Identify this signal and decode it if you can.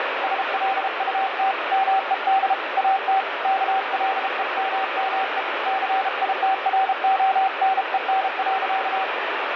Morse code, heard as a keyed tone, hand-sent with a paddle, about 33 wpm, 770 Hz, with heavy radio static. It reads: SLUT MED AT KLEMME CITRONEN.